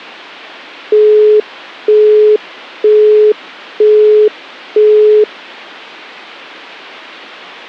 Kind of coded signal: telephone call progress tone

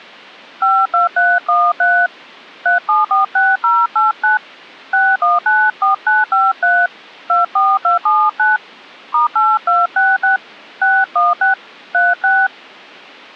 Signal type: DTMF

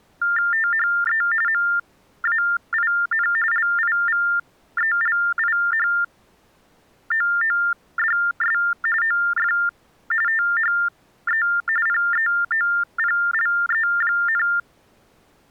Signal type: TTY/TDD text telephone tones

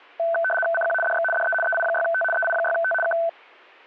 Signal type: RTTY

